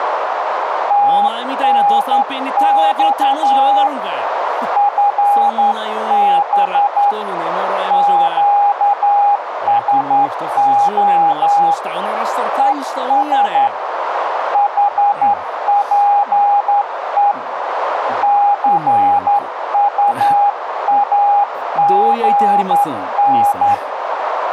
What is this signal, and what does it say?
Morse code, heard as a keyed tone, hand-sent with a straight key, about 11 wpm, 810 Hz, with radio static and a narrow filter. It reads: TNX FB QSO ES HPE CUAGN